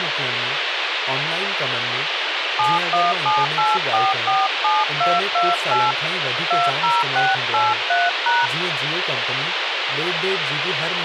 DTMF, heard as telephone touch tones, dialled by hand, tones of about 200 ms, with radio hiss and speech in Sindhi. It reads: 7178447228 20683#